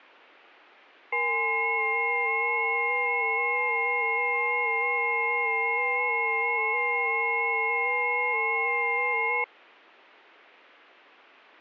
FT8 (several signals at once), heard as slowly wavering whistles, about 6.25 baud.